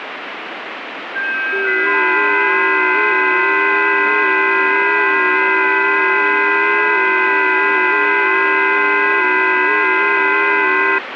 FT8 (several signals at once), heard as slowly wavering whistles, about 6.25 baud, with radio static.